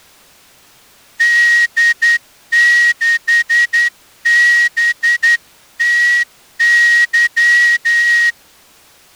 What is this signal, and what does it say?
Morse code, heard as a whistle, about 10 wpm. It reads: D6BTY